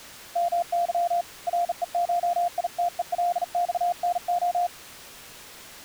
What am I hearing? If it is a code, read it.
Morse code (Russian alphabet), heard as a keyed tone, hand-sent with a bug key, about 40 wpm, 700 Hz. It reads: МЫ РЕШИТЕЛЬНО